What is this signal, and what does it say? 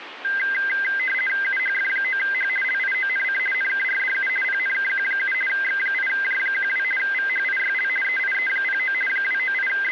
RTTY (50 baud, 450 Hz shift), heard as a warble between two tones, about 1800 Hz centre, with radio static. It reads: UHF9H LIONC NKRDU PNKQ7 X8J12 VHIYL EIE09 …